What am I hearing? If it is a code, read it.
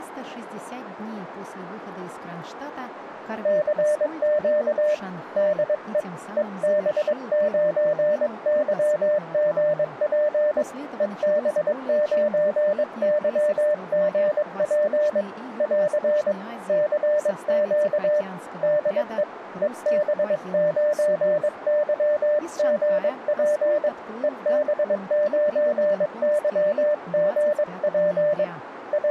Morse code, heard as a keyed tone, hand-sent with a paddle, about 22 wpm, 600 Hz, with radio static and speech in Russian. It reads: CQ DE EB9YGP EB9YGP <AR> CQ DE EB9YGP EB9YGP …